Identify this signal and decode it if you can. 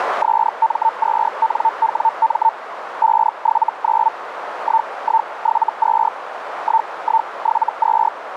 Hellschreiber (Feld-Hell, 122.5 baud), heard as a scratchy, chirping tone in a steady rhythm, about 900 Hz, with radio static and a narrow filter. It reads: SM2NWM 579 1172 1172